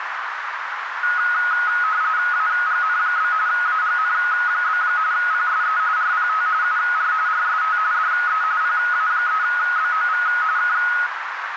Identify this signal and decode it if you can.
RTTY (45.45 baud, 170 Hz shift), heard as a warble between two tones, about 1360 Hz centre, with radio static and a narrow filter. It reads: AGN? AGN? PSE RPT UR RST DE PA3BOV K